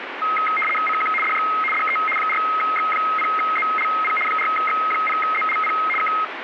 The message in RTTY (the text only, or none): CQ DX DE 4X0ZLP 4X0ZLP K